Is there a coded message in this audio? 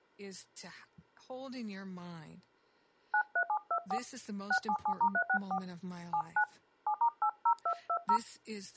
Yes: DTMF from 3.1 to 8.2 s, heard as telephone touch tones, dialled by hand, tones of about 80 ms, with speech in English. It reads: 93724 677*364 79 7*80220